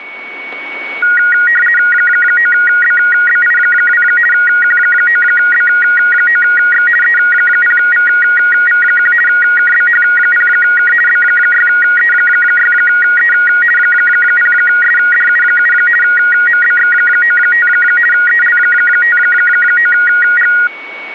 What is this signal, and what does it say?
RTTY (50 baud, 450 Hz shift), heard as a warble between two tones, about 1650 Hz centre, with a steady whistle near 2230 Hz. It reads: 9BBI2 Q9B9X E0VV1 KBH0K B6E6E 0SDU7 MBX95 EL59G